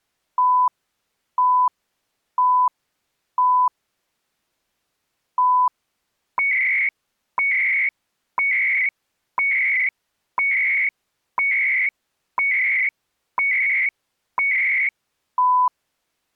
Radio time signal (CHU, Canada), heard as beeps and data bursts, one a second.